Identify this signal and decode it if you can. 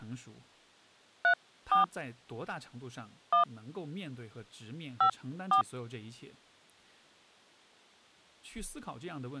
DTMF, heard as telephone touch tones, dialled by hand, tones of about 110 ms, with speech in Chinese. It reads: 34 1 54